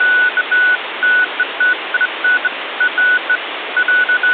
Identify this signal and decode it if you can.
Beeps of irregular length, with phone line noise. There is no code.